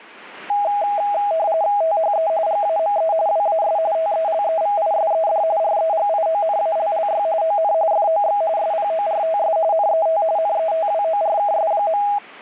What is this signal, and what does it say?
RTTY (45.45 baud, 170 Hz shift), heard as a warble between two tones, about 730 Hz centre. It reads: THE GAME WAS TELEVISED REGIONALLY ON FOX SPORTS NET NETWORKS.